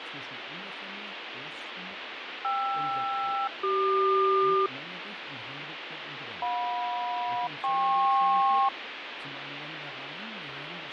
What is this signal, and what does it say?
Aircraft SELCAL, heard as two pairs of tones, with radio static and fading. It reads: KR-CQ JM-KP